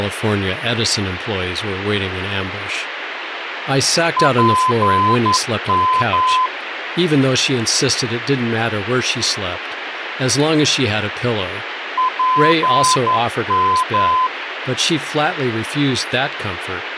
Morse code, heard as a keyed tone, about 11 wpm, 1020 Hz, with radio hiss and speech in English. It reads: PM PM